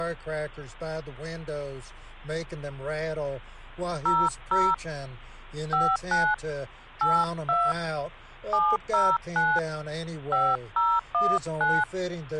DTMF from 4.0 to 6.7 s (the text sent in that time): 00 59